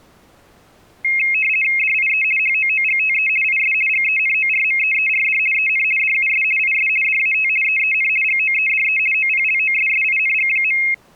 RTTY (50 baud, 450 Hz shift), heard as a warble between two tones, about 2350 Hz centre. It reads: DIE HOOGTE IS GENORMEERD EN DUS IS DAT EEN GOEDE OPLOSSING.